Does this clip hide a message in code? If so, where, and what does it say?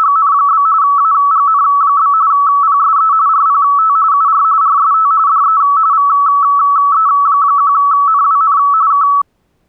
Yes: RTTY (45.45 baud, 170 Hz shift) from 0.0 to 9.2 s, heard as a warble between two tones, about 1220 Hz centre. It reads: … AGN? PSE RPT UR RST DE VE1NWN K